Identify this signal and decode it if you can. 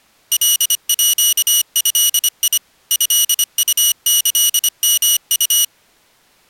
Morse code (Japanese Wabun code), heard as a high beeper, machine-sent, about 25 wpm, 2900 Hz. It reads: カード トウキヨウ